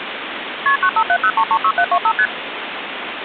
Multi-frequency trunk signalling (R1, as on North American trunks), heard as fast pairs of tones, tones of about 70 ms, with phone line noise. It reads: KP 9570336725 ST